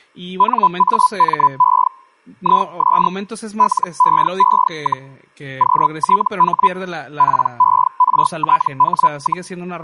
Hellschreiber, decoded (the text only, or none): NAME IS LEE, QTH PERTH,